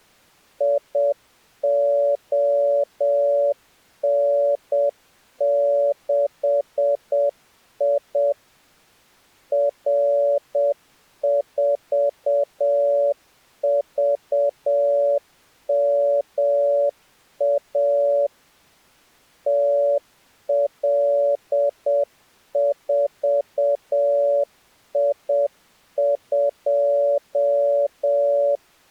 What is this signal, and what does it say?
Morse code, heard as a keyed tone, machine-sent, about 7 wpm, 570 Hz. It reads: ION6I R4VMA TL4I2